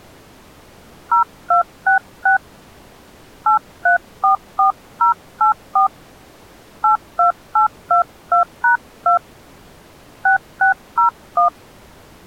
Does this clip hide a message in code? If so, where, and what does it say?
Yes: DTMF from 1.1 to 11.5 s, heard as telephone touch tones, dialled by hand, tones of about 120 ms. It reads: 0266 8344084 82822#2 6601